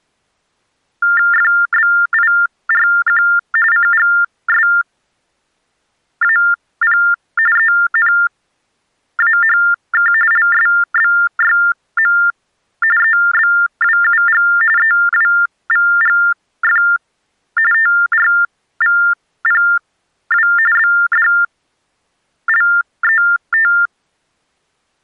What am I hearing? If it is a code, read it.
TTY/TDD text telephone tones (45.45 baud Baudot), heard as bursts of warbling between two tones, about 400 Hz shift, 1600 Hz centre. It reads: FBIRQ CGSAP ENAHK LSBYM EBWUG EWVGF TRVPW BDLET